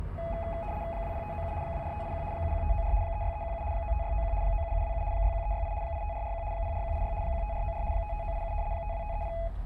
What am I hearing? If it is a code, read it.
RTTY (75 baud, 170 Hz shift), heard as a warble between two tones, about 750 Hz centre, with the noise inside a car. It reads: 20597 24581 71594 36317 95691 97727 61368 85441 04186 15494 55987 52530